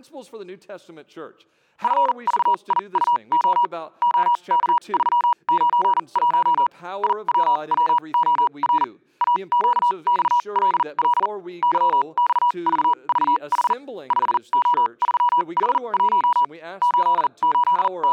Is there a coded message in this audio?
Yes: Morse code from 1.8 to 18.1 s, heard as a keyed tone, machine-sent, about 40 wpm, spaced as for 31 wpm, 970 Hz. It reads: FVIUO OK391 IWWOR AQXLL YXVVH 5O3H1 …